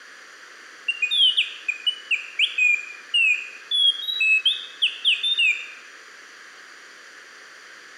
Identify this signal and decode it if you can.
Bird-like chirps, with room echo. There is no code.